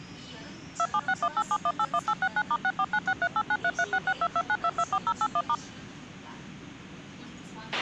DTMF, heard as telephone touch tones, dialled by machine, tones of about 60 ms, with a squelch burst at the end and the noise inside a subway train. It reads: 276187181869*64963893366229224081*